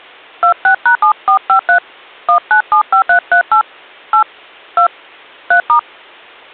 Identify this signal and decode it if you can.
DTMF, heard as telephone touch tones, dialled by hand, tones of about 100 ms. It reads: 26#7453 1975338 8 2 3*